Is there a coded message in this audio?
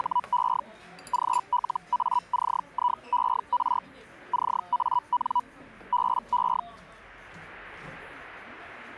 Yes: Hellschreiber (Feld-Hell, 122.5 baud) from 0.0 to 6.6 s, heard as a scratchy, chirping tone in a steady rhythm, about 980 Hz, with the noise of a crowd indoors. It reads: … GLACIER CAN BE